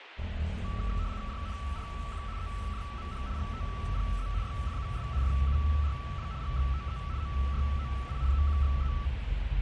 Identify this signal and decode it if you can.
RTTY (75 baud, 170 Hz shift), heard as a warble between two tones, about 1230 Hz centre, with radio static and the noise inside a car. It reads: JNRQ EJMH GTPZ YFUS FURW GXTE OYOI EQXE